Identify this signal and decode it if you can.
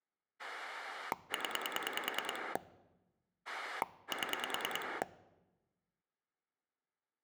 Pulse dialling, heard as a rotary dial, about 10 pulses a second. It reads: 0 7